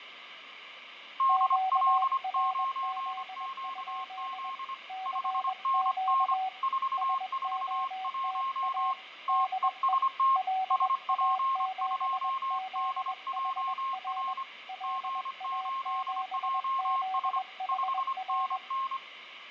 Morse code, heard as two keyed tones, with radio static and fading. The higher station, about 25 wpm, 1070 Hz: DL9QZ 5NN 441 TEST SP2DJR G8JS 5NN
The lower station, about 21 wpm, 760 Hz: QRZ? CQ SOTA DE LA7ZHR LA7ZHR